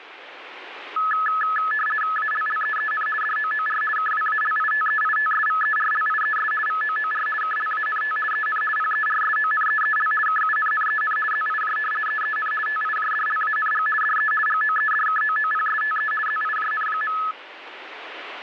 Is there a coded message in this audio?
Yes: RTTY (50 baud, 450 Hz shift) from 1.0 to 17.3 s, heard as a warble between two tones, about 1500 Hz centre, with radio static. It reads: ALLEEN DOOR KWALITEITSVERLIES VOOR KLANT EN PERSONEEL KUNNEN ZIJ EEN TIJDLANG DE GOEDKOOPSTE ZIJN.